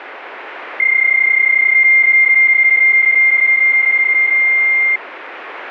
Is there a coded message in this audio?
Yes: PSK31 (31.25 baud) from 0.8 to 5.0 s, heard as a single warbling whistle, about 2100 Hz, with radio static.